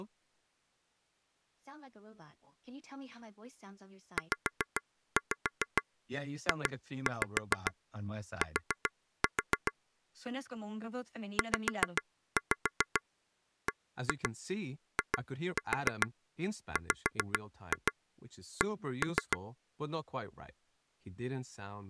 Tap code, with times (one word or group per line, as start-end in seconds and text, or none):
4.2-9.7 ZJT
11.4-19.4 ZBIWC